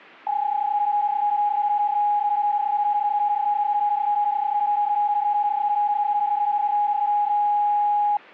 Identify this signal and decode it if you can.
PSK31 (31.25 baud), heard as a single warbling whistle, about 830 Hz.